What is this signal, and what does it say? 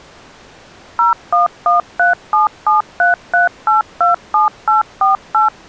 DTMF, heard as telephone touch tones, dialled by machine, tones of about 140 ms. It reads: 01137733827848